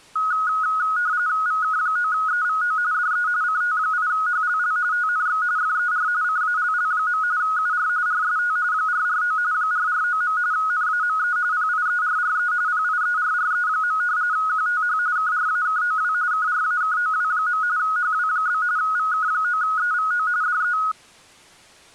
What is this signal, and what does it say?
RTTY (45.45 baud, 170 Hz shift), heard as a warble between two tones, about 1360 Hz centre. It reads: VK9EVO DE CT8HLL TNX FER CALL. UR RST 449 449. NAME PIERRE PIERRE. QTH KRAKOW KRAKOW. HW? VK9EVO DE